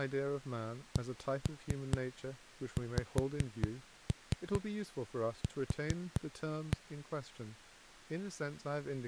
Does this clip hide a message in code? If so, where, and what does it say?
Yes: tap code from 1.0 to 6.8 s, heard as knocks on a wall, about 4 knocks a second, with speech in English. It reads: CXQ